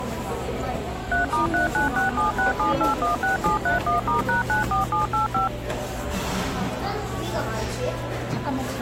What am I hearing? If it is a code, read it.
DTMF, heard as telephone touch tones, dialled by machine, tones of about 130 ms, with the noise of a cafe. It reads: 3*396767816731*#94785